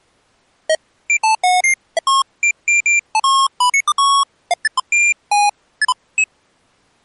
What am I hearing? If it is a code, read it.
Electronic bleeps of random pitch and length. There is no code.